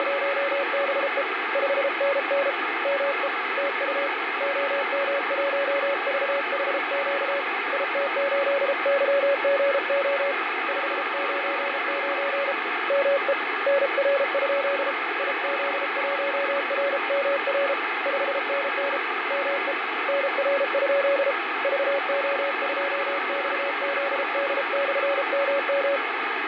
Morse code, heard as a keyed tone, hand-sent with a paddle, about 33 wpm, 560 Hz, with radio static and fading. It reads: … 5NN ME TU OM1VHQ IT8YGO 599 ME NR? IZ1RMR 5NN ME NR? VO2XZD/MM